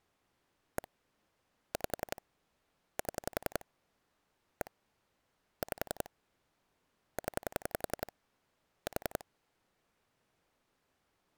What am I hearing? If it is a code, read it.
Pulse dialling, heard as clicks on a phone line, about 11 pulses a second. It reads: 1 5 7 1 5 0 4